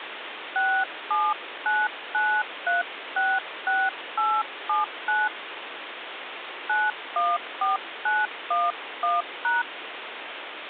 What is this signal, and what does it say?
DTMF, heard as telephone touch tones, dialled by hand, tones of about 220 ms, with phone line noise. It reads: 6799366879 914911#